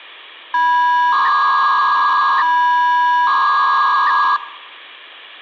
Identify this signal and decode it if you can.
300-baud modem data (V.21 tones), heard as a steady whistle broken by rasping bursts, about 300 baud, 200 Hz shift, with hum.